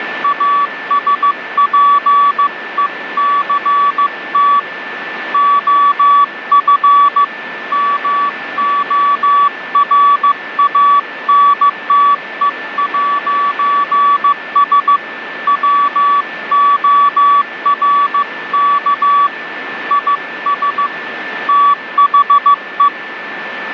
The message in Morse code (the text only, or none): ASPECT OF MORANTE'S WORK IS THE